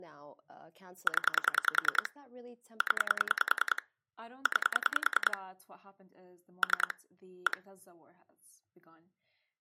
Pulse dialling, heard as clicks on a phone line, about 10 pulses a second, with speech in English. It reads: 0 0 9 3 1